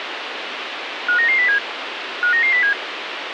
Five-tone selective call (CCIR), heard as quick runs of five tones, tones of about 100 ms, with radio hiss. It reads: 59907 59907